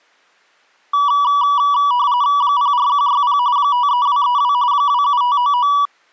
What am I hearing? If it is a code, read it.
RTTY (45.45 baud, 170 Hz shift), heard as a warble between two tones, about 1060 Hz centre. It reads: 04160 53232 27599